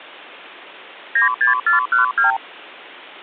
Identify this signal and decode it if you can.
Multi-frequency trunk signalling (R2, with the far end's replies), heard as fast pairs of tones, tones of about 130 ms. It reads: 96412